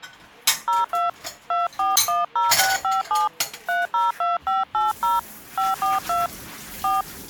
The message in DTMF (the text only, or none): 02 2410657 302580 542 4